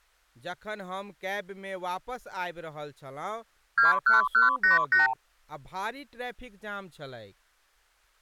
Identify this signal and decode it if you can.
Multi-frequency trunk signalling (R2, with the far end's replies), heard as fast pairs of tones, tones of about 140 ms, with speech in Maithili. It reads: 21188